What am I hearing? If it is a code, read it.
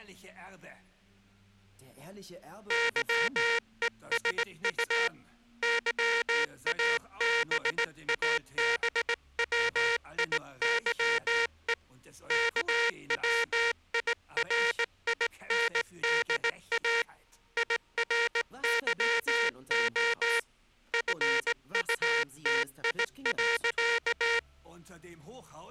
Morse code, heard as a buzzer, hand-sent with a straight key, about 18 wpm. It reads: YESU YABABWIYE KWIRINDA IRYO FUTI.